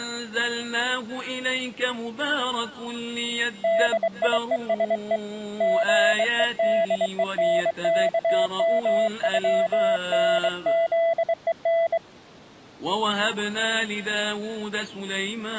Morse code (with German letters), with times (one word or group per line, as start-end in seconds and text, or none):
3.6-5.2 DIESE
5.6-12.0 GEDENKMÜNZEN